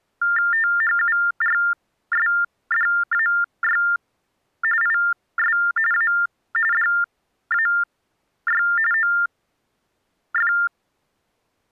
TTY/TDD text telephone tones (45.45 baud Baudot), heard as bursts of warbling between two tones, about 400 Hz shift, 1600 Hz centre. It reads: THURSDAY IS A DAY OF